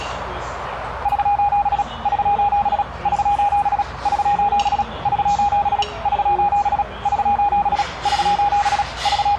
Morse code, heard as a keyed tone, machine-sent, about 36 wpm, 820 Hz, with radio static and the noise of a restaurant. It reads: <SOS> <SOS> <SOS> <SOS> <SOS> <SOS> <SOS> <SOS> …